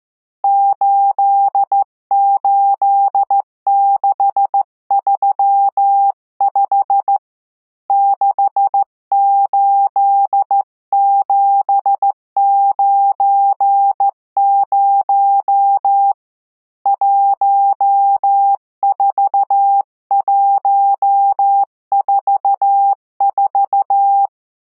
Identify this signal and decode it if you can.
Morse code, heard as a keyed tone, hand-sent with a straight key, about 14 wpm, 800 Hz. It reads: 88635 68790 14144